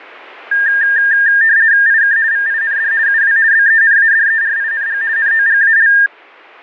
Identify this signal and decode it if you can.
RTTY (50 baud, 170 Hz shift), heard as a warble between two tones, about 1700 Hz centre. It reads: IK VIND UW BENADERING NOGAL